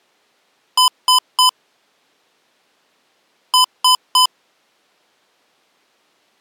Beep code, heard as beeps from a small speaker, played twice, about 1010 Hz. 3 short. In AMI BIOS tables: failure in the first 64 KB of memory; in Dell tables: chipset error.